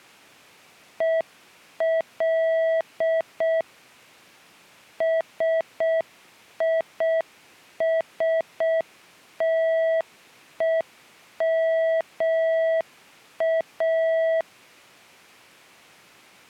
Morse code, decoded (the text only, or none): EL SISTEMA